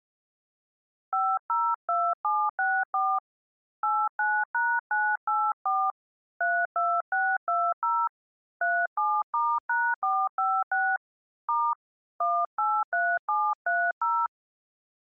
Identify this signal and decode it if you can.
DTMF, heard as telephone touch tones, dialled by hand, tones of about 250 ms. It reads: 502764 89#984 32620 37*#456 * 183730